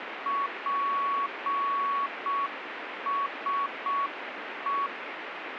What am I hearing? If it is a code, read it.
Morse code, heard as a keyed tone, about 6 wpm, 1120 Hz, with radio static. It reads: PSE